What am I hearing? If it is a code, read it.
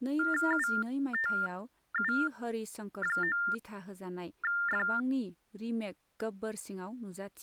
TTY/TDD text telephone tones (45.45 baud Baudot), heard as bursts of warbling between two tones, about 400 Hz shift, 1600 Hz centre, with speech in Bodo. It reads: UTU9F